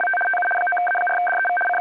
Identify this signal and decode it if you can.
RTTY (75 baud, 850 Hz shift), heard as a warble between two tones, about 1140 Hz centre, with a steady whistle near 2270 Hz. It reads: … TU 9A4DEV …